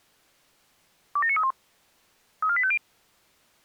Five-tone selective call (ZVEI), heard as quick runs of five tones, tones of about 70 ms. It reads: 27931 34850